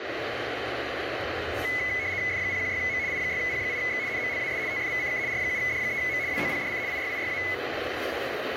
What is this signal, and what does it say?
RTTY (75 baud, 170 Hz shift), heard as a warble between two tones, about 2100 Hz centre, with radio static, room echo and the noise of a cafe. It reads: F016M I6P8X NMLAS TFVCK R7D3M WOPDC IYIYA